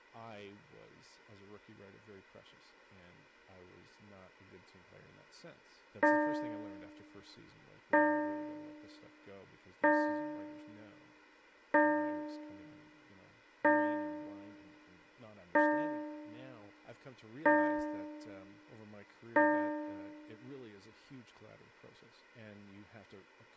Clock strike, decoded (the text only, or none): 8